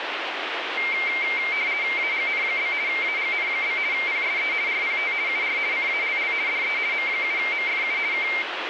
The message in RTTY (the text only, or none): AGN? AGN? PSE RPT UR CALL DE M7MFU K